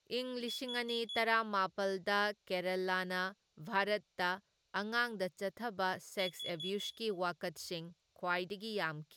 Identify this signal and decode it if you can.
Alarm pattern, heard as an alarm's beeps, played twice, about 3400 Hz, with room echo and speech in Manipuri. Temporal four. Carbon monoxide.